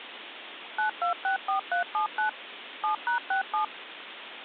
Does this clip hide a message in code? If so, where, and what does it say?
Yes: DTMF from 0.8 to 3.6 s, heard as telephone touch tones, dialled by machine, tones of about 110 ms, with phone line noise. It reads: 9264379 7#67